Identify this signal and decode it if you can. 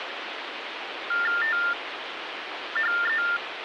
TTY/TDD text telephone tones (45.45 baud Baudot), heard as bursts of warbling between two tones, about 400 Hz shift, 1600 Hz centre, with phone line noise. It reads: THE